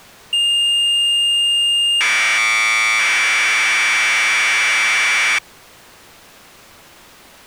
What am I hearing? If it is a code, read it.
Commodore tape loading (standard loader), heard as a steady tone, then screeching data.